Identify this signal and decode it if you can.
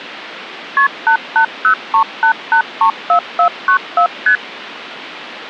Multi-frequency trunk signalling (R1, as on North American trunks), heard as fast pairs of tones, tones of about 90 ms. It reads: KP 88038834494 ST